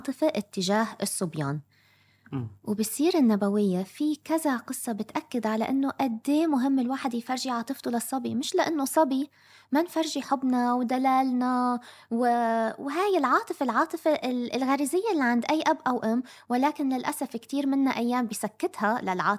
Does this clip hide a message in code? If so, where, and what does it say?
No, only speech in Arabic.